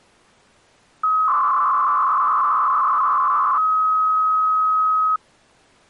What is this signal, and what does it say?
300-baud modem data (Bell 103 tones), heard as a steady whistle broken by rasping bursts, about 300 baud, 200 Hz shift.